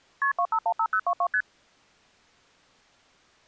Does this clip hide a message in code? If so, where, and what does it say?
Yes: multi-frequency trunk signalling (R1, as on North American trunks) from 0.2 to 1.4 s, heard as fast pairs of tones, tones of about 70 ms. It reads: KP 2515022 ST